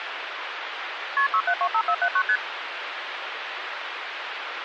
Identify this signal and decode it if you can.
Multi-frequency trunk signalling (R1, as on North American trunks), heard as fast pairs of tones, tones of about 70 ms, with phone line noise. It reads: KP 6725479 ST